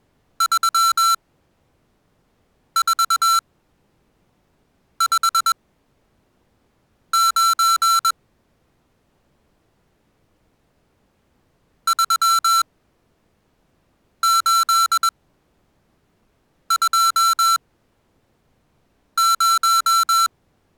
Morse code, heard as electronic beeps, machine-sent, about 21 wpm, spaced as for 5 wpm, 1350 Hz. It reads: 3459 3820